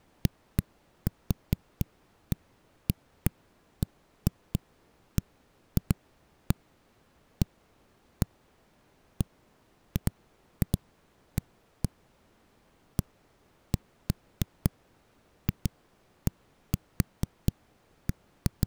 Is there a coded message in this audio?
No, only irregular knocks on a wall.